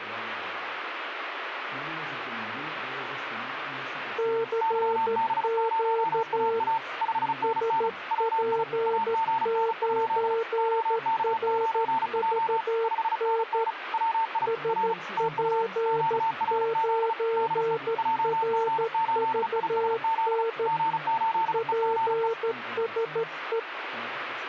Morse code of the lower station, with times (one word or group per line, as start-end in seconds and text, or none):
4.2-6.6 CQ
7.4-13.6 SP9RVN
14.5-20.7 SP9RVN
21.5-23.6 PSE